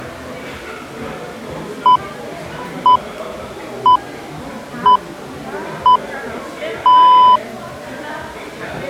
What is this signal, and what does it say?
Radio time signal (six pips, as the Greenwich Time Signal), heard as pips, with the noise of a restaurant.